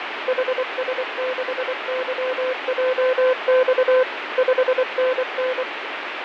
Morse code, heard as a keyed tone, machine-sent, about 24 wpm, 510 Hz, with radio static and fading. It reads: HS6YJX 5NN